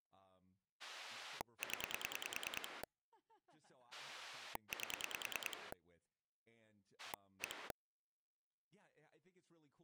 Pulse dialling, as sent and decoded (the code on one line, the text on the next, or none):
10 / 8 / 1
0 8 1